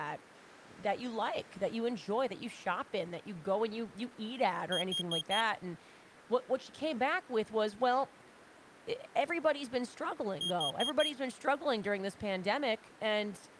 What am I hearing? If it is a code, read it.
Alarm pattern, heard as an alarm's beeps, played twice, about 3250 Hz, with speech in English. Temporal four. Carbon monoxide.